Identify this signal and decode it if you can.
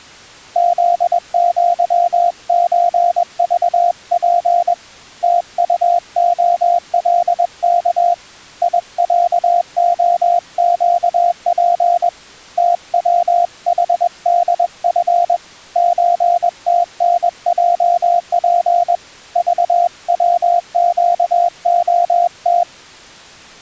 Morse code (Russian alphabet), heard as a keyed tone, hand-sent with a paddle, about 21 wpm, 700 Hz. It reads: ЗЪЧЖП ТУОЛК ИЯОЩП ТВХДФ ЧТНЙП ЖВЩОТ